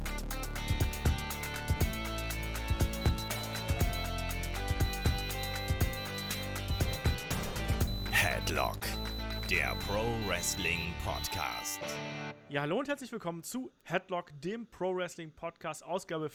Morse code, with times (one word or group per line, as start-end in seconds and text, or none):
3.0-4.0 HE
4.8-7.1 WAS
7.9-11.6 BORN